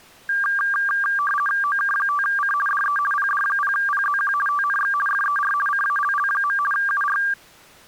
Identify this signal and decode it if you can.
RTTY (50 baud, 450 Hz shift), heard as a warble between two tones, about 1380 Hz centre. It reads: OK5C DE PD0PZQ TNX FER CALL. UR